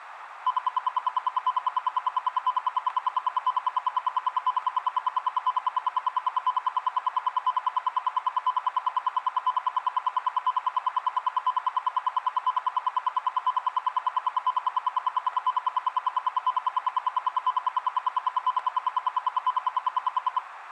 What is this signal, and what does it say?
Radio time signal (RWM, Moscow), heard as ten pulses a second, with radio static and room echo.